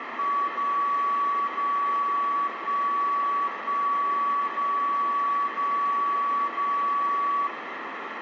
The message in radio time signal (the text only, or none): 0 0 1 1 0 0 0